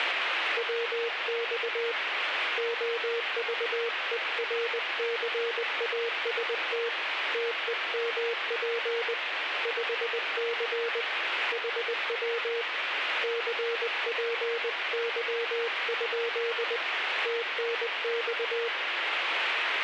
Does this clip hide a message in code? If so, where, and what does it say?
Yes: Morse code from 0.5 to 18.7 s, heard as a keyed tone, hand-sent with a paddle, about 20 wpm, 470 Hz, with radio static. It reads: WX OVERCAST TEMP 5C HW CPY? TNX